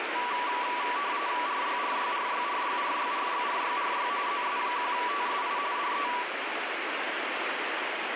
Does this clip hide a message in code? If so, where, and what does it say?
Yes: RTTY (45.45 baud, 170 Hz shift) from 0.2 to 6.2 s, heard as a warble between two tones, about 1060 Hz centre, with radio static. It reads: RYRYRYRYRYRYRYRY ZS1TSI DE